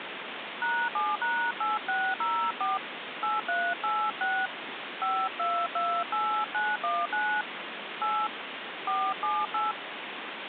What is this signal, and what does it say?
DTMF, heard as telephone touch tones, dialled by hand, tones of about 250 ms, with phone line noise. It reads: #7#8604 8386 5228919 8 478